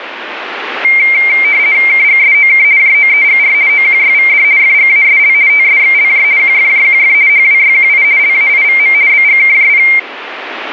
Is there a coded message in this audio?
Yes: RTTY (50 baud, 170 Hz shift) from 0.8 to 10.0 s, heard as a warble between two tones, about 2200 Hz centre, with radio static. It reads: KGSOK JOEGR OQYVD FGASL TSXLJ QFJQF HWYQI LAIVM BGKJP